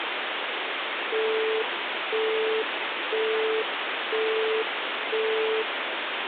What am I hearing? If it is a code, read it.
Telephone call progress tone (single-tone plan, as in Europe, Japan and elsewhere), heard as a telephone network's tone, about 440 Hz, 0.5 s on and 0.5 s off, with phone line noise. Busy tone.